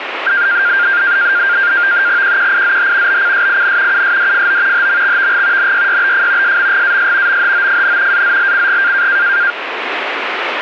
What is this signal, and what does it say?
NAVTEX (SITOR-B), 100 baud, 170 Hz shift, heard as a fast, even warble, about 1500 Hz centre, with radio static. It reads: QQIZH BCSIN USDFO HMXVG NYYBF SMGAS MHOFN AZLCG